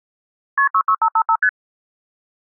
Multi-frequency trunk signalling (R1, as on North American trunks), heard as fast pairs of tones, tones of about 70 ms. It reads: KP 66555 ST